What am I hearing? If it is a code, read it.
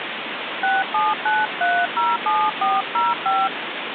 DTMF, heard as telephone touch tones, dialled by hand, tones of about 200 ms, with phone line noise. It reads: 679307405